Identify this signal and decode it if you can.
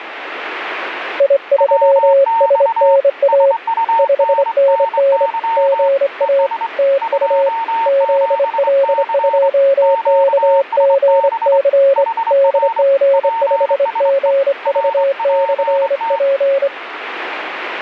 Morse code, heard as two keyed tones, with radio static. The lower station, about 25 wpm, 550 Hz: I3SNA 5NN GA TU ZL2KGC DG5GV/P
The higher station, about 24 wpm, 910 Hz: WX SUNNY ES 27C QSB HR PSE RPT